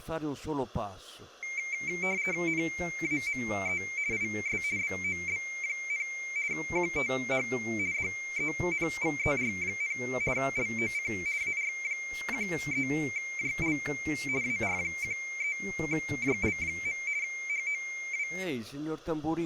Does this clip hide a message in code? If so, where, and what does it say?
Yes: RTTY (50 baud, 170 Hz shift) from 1.4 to 18.4 s, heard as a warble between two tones, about 2200 Hz centre, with speech in Italian. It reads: NAME IS BOB, QTH DENVER, LOC AR13JL AR13JL. HOW